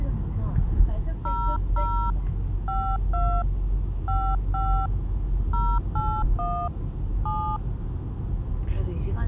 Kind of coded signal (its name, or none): DTMF